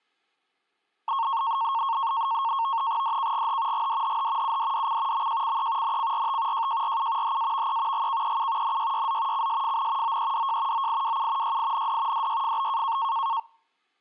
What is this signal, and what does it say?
NAVTEX (SITOR-B), 100 baud, 170 Hz shift, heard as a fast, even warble, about 1000 Hz centre. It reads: DKGH GDHH UDDC MJCE NCRT JJRU HAVE GKEU NYYZ CSFN OEDJ OIWU YIND DYFB